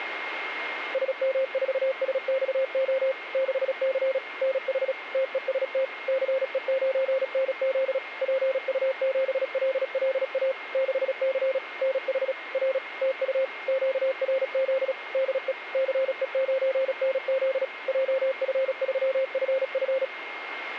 Morse code, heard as a keyed tone, machine-sent, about 36 wpm, 530 Hz, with radio static and a steady whistle near 2130 Hz. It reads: SM4SXO 6C NH TEST CE9NZ PU7LLA 6C NH R TU QRZ DE CE9NZ JF3FF